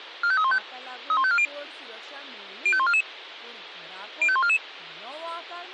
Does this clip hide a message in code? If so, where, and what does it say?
Yes: five-tone selective call (ZVEI) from 0.2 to 4.6 s, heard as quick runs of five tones, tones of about 70 ms, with speech in Goan Konkani. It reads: 45315 31540 05144 05144